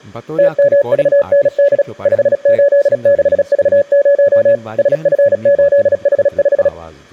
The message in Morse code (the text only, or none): TMVND 586V0 SF8H5